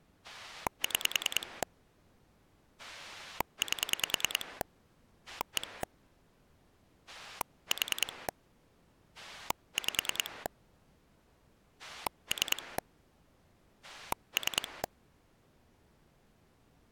Pulse dialling, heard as a rotary dial, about 10 pulses a second. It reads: 6 8 1 4 5 3 3